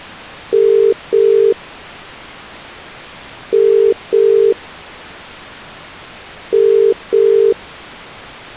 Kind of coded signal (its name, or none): telephone call progress tone